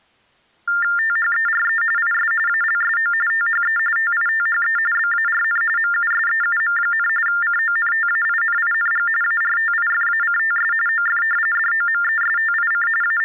TTY/TDD text telephone tones (45.45 baud Baudot), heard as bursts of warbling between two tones, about 400 Hz shift, 1600 Hz centre. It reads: THERE IS ALSO THE TITHE BARN MUSEUM, CONTAINING ARTIFACTS OF DOMESTIC …